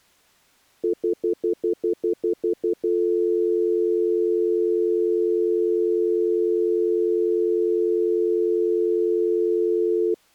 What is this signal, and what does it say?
Telephone call progress tone (North American plan), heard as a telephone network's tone, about 350, 440 Hz, 0.1 s on and 0.1 s off. Stutter dial tone.